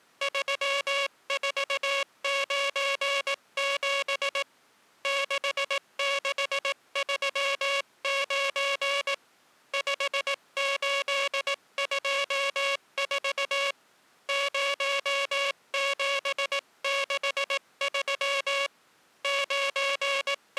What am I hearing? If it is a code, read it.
Morse code, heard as a buzzer, hand-sent with a paddle, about 18 wpm. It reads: 3497 6639 5824 0763 …